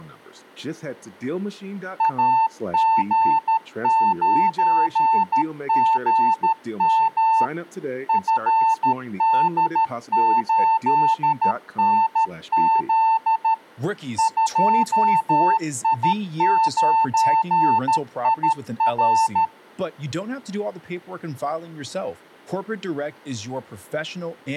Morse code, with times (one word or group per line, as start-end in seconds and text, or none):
2.0-7.4 AG9GM
8.1-13.5 FD8NZ
14.2-19.4 2I9IR